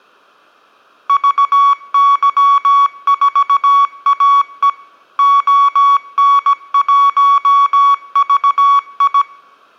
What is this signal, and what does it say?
Morse code, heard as electronic beeps, machine-sent, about 17 wpm, 1120 Hz. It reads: VY4AE ON1VI